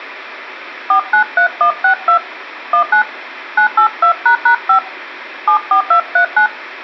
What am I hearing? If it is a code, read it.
DTMF, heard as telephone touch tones, dialled by hand, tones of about 100 ms. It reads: 493162 19 982##5 74239